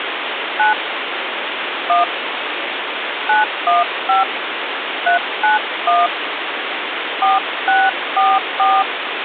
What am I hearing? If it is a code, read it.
DTMF, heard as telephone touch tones, dialled by hand, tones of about 170 ms, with phone line noise. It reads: 9 1 915 391 4644